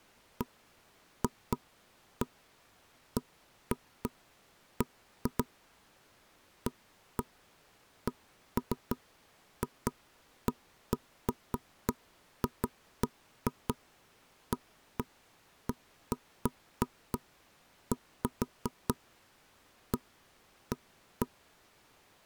Irregular knocks on wood. There is no code.